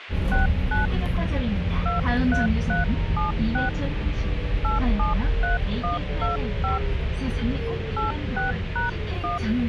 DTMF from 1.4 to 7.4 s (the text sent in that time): 23376 873125